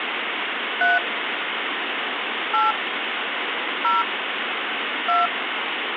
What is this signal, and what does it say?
DTMF, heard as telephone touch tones, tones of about 170 ms, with phone line noise. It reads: 3 8 0 2